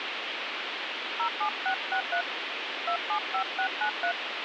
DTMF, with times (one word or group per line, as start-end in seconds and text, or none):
1.2-2.2 07663
2.9-4.1 275693